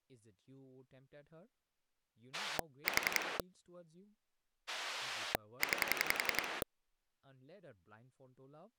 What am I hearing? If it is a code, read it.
Pulse dialling, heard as a rotary dial, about 11 pulses a second, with speech in English. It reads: 4 9